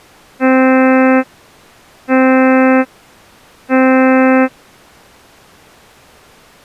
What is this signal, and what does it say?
Ship horn signal, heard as a ship's horn, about 260 Hz. 3 short. At sea: I am operating astern propulsion.